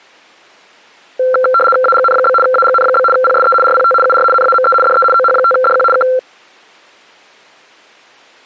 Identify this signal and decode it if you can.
RTTY (75 baud, 850 Hz shift), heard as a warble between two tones, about 940 Hz centre. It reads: AGN? AGN? PSE RPT UR NAME DE OH5DQ K